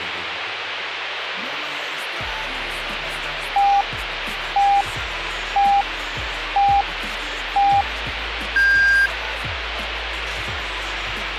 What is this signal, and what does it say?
Radio time signal (five pips and a higher one, as on Chinese radio), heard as pips, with radio hiss.